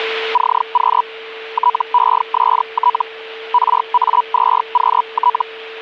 Hellschreiber (Feld-Hell, 122.5 baud), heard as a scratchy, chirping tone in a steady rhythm, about 980 Hz, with a steady whistle near 450 Hz. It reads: CQ TEST RA2QT